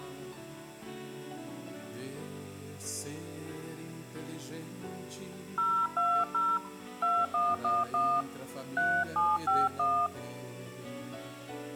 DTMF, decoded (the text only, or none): 020 2111 3751